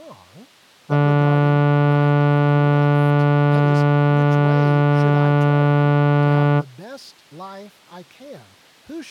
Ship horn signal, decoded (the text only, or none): 1 long